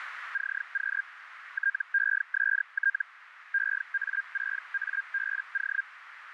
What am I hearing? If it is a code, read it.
Hellschreiber (Feld-Hell, 122.5 baud), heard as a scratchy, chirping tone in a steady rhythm, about 1600 Hz, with radio static and a narrow filter. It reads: CQ TEST EA6ABO